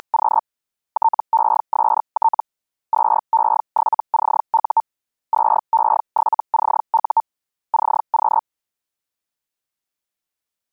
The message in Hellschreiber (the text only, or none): … TEST 2E7CU 2E7CU CQ